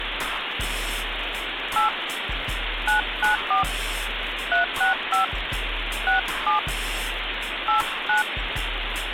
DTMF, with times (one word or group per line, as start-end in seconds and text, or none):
1.8-1.9 8
2.9-3.6 994
4.5-5.2 365
6.1-6.6 67
7.7-8.2 89